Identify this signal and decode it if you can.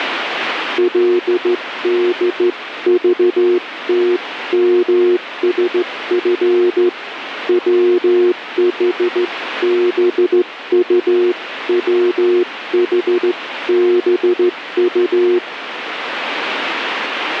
Morse code (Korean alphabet), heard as a keyed tone, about 14 wpm, 360 Hz, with radio static. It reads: 그러면 부디부디